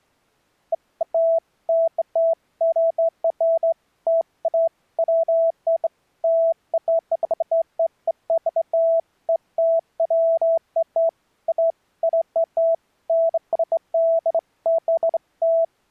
Beeps of irregular length. There is no code.